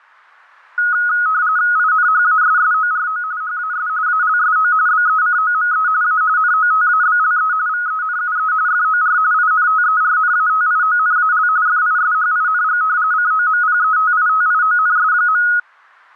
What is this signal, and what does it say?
RTTY (45.45 baud, 170 Hz shift), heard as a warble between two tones, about 1360 Hz centre. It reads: INHASSORO HAS ALSO BECOME A NOTABLE VENUE FOR INTERNATIONAL FISHING COMPETITIONS.